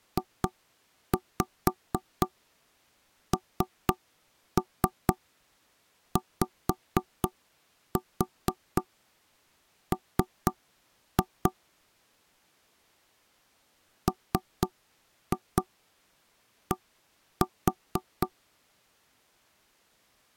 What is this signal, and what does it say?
Tap code, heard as knocks on wood, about 4 knocks a second. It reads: JNYM MD